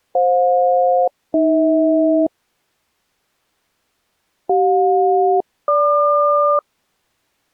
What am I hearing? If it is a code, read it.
Aircraft SELCAL, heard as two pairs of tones. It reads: FJ-AH CJ-GQ